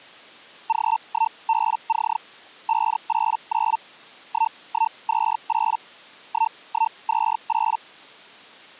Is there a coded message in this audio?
Yes: Hellschreiber (Feld-Hell, 122.5 baud) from 0.7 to 7.8 s, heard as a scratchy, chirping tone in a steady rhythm, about 900 Hz. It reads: G1BC 589 1128 1128